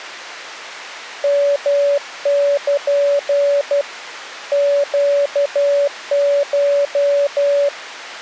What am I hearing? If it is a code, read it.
Morse code (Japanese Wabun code), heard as a keyed tone, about 12 wpm, 570 Hz. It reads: ヨル ネコ